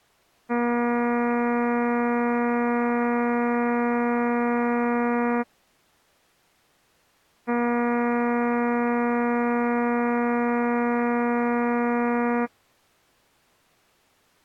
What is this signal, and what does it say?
Ship horn signal, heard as a ship's horn, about 240 Hz. 2 long. At sea: a vessel under power that has stopped in fog.